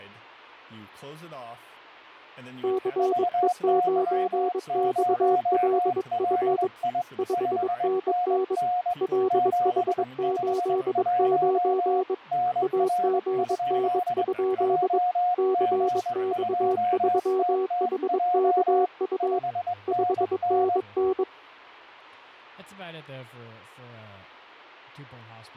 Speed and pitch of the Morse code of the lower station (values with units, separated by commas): 22 wpm, 380 Hz